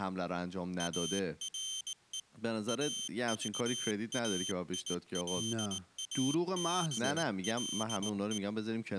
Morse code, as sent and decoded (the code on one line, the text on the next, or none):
.- .-. . / .- ...- .- .. .-.. .- -... .-.. .
ARE AVAILABLE